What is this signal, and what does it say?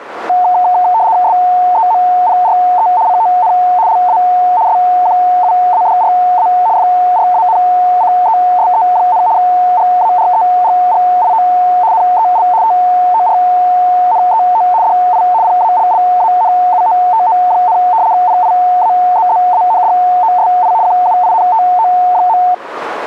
RTTY (75 baud, 170 Hz shift), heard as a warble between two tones, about 810 Hz centre. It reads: SEMPRE CON LA SQUADRA FRANCESE, GAREGGIO NEL TORNEO DI PALLANUOTO, PIAZZANDOSI QUINTO.